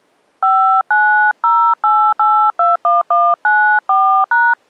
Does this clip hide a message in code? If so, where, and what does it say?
Yes: DTMF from 0.4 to 4.5 s, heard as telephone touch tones, dialled by hand, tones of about 290 ms. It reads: 5908821194#